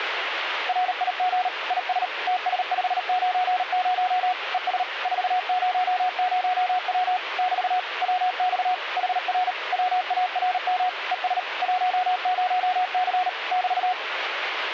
Morse code, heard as a keyed tone, machine-sent, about 38 wpm, 730 Hz, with radio static. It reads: RIG IS TS590 ES 400W <BT> WX HR WARM ES 10C <BT>